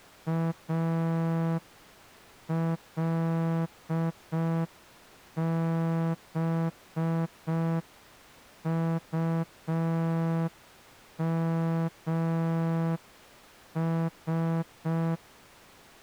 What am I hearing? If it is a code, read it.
Morse code, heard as a horn, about 5 wpm. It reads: ALBUMS